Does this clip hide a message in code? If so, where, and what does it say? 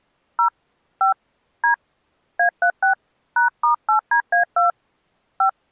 Yes: DTMF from 0.4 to 5.5 s, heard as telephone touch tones, dialled by hand, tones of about 110 ms. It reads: 0 5 D A36 #*8DA2 5